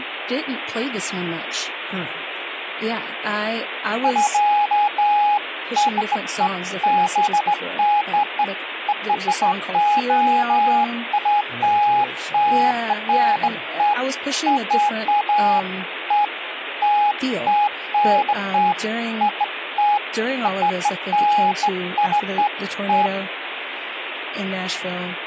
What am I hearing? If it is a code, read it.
Beeps of irregular length, with phone line noise and speech in English. There is no code.